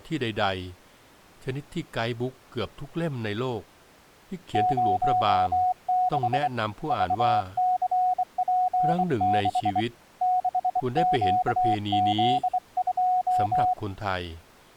Morse code, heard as a keyed tone, hand-sent with a straight key, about 24 wpm, 730 Hz, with speech in Thai. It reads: 06 VCP6 6QZ2